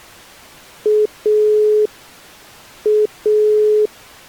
Telephone call progress tone (pulsed, as in Italy), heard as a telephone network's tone, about 420 Hz. Dial tone.